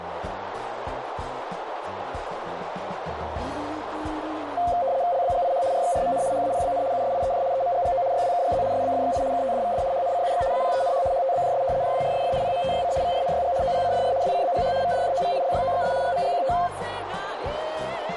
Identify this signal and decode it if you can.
RTTY (75 baud, 170 Hz shift), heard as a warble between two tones, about 620 Hz centre, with radio static and a narrow filter. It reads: LBGIH RXRMN HAPBN USIEJ EMGGO YWKGZ SBFXI KTDVD HNCUX APENH HTBJS JDRSF PMTYC VRNYG OPCFR WCBGH VDJOV LYOXS GMGQT